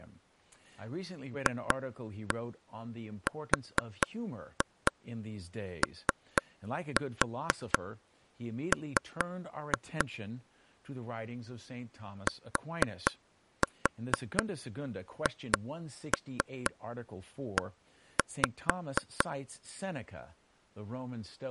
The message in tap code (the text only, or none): FROM THE